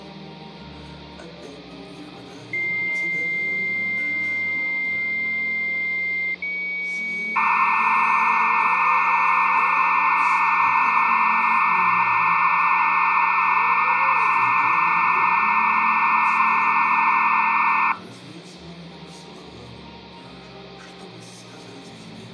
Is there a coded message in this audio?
Yes: dial-up modem handshake (low-speed, two carriers) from 2.5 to 17.9 s, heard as two whistles, then hiss, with hum and room echo.